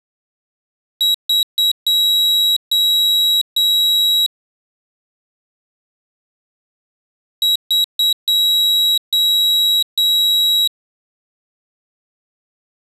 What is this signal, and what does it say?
Beep code, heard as a piezo beeper, played twice, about 3850 Hz. 3 short, 3 long.